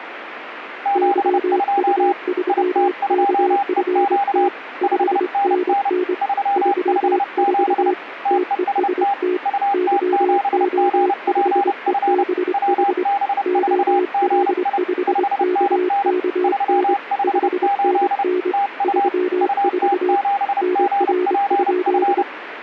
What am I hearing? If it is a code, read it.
Morse code, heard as two keyed tones, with radio static. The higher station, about 30 wpm, 800 Hz: 72 IT2EQ 5NN 357 TEST UT7GPF WB4GI 5NN 358 TU UT7GPF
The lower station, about 25 wpm, 360 Hz: YU3KFT 5NN 34 TEST YO5EBH OL5KKN 5NN 34 NR?